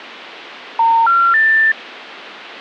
Telephone call progress tone (North American plan), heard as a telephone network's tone, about 910, 1370, 1800 Hz. Special information tone.